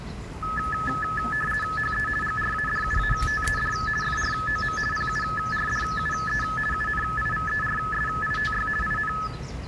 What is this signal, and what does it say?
RTTY (50 baud, 450 Hz shift), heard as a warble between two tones, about 1500 Hz centre, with the noise of a park. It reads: HE GRADUATED FROM PURDUE UNIVERSITY IN